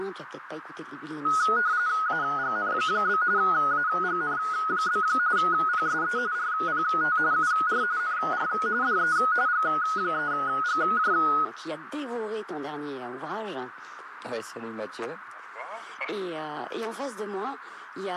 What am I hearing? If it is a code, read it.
RTTY (45.45 baud, 170 Hz shift), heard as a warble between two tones, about 1360 Hz centre, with radio static and a narrow filter. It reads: AGN? AGN? PSE RPT UR NR DE G3GJ